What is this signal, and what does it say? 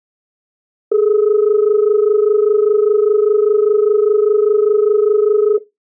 Telephone call progress tone (as in Australia), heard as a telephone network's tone, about 430 Hz. Dial tone.